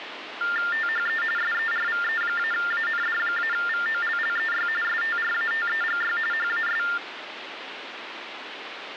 TTY/TDD text telephone tones (45.45 baud Baudot), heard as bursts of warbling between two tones, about 400 Hz shift, 1600 Hz centre, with phone line noise. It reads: THE SERVE-AND-VOLLEY STRATEGY HAS